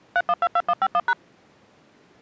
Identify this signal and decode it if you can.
DTMF, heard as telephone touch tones, dialled by machine, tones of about 50 ms. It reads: 3122151#